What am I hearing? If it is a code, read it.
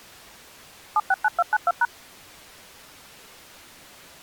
DTMF, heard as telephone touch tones, dialled by machine, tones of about 40 ms. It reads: 769292#